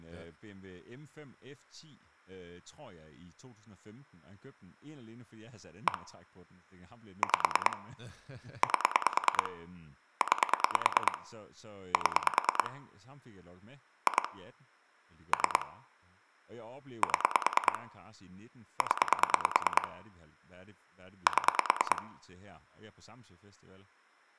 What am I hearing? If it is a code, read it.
Pulse dialling, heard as clicks on a phone line, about 9 pulses a second, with room echo and speech in Danish. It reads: 1 5 8 9 7 2 3 7 0 7